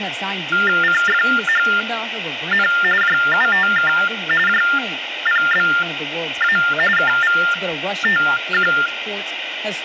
TTY/TDD text telephone tones (45.45 baud Baudot), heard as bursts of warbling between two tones, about 400 Hz shift, 1600 Hz centre, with phone line noise and speech in English. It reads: CFHN JUTK JPBA KVTQ